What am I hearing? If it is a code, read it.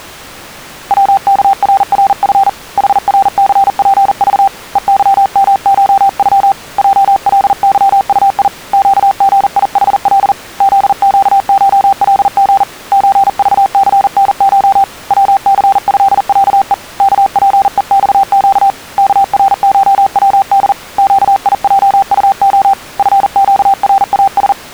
Morse code (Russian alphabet), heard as a keyed tone, hand-sent with a paddle, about 40 wpm, 780 Hz. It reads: ВКРРФ ХРЦПЖ ЕЫМШЮ ЙЛЫУИ ЩГИХЛ ЗЩШЛГ ЧЖЦНШ ВЦЭЯЕ КПЕЬЩ КРШВД ЩИЙУО ФЩРАС